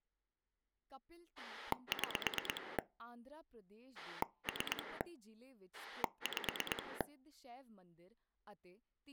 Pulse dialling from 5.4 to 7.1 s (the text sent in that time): 5